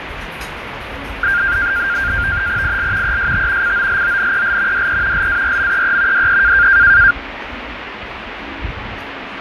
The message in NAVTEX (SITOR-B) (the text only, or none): IL EST COLONEL DE LARMEE DE